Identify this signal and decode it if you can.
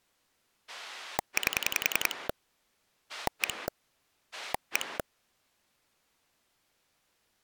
Pulse dialling, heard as a rotary dial, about 10 pulses a second. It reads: 8 1 1